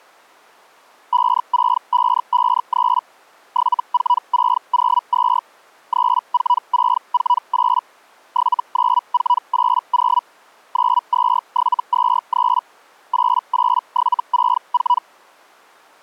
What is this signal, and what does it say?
Hellschreiber (Feld-Hell, 122.5 baud), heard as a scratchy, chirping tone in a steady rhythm, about 980 Hz. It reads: 56553 74602 34648 79480 92723 88764